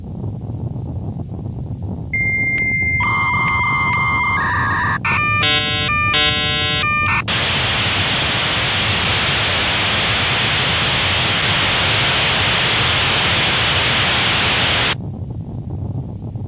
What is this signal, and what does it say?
Dial-up modem handshake (V.34 or later), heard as a whistle, warbles, then hiss.